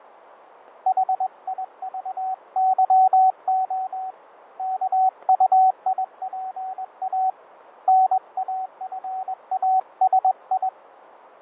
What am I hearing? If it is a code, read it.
Morse code, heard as a keyed tone, hand-sent with a straight key, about 21 wpm, 750 Hz, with radio static and fading. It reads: HIVYO KUIPA NAFASI